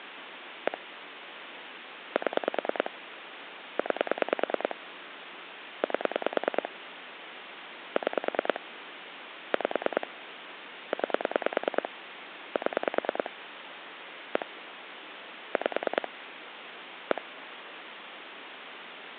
Pulse dialling, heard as clicks on a phone line, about 9 pulses a second, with phone line noise. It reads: 1 7 9 8 6 5 9 7 1 5 1